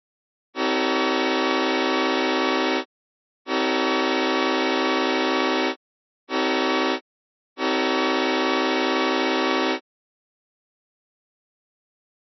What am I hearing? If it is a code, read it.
Train horn signal, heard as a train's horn. 2 long, 1 short, 1 long. On North American railways: approaching a public crossing.